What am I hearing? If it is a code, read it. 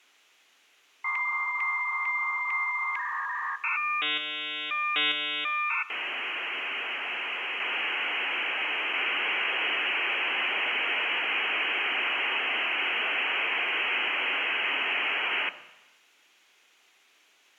Dial-up modem handshake (V.34 or later), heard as a whistle, warbles, then hiss, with room echo.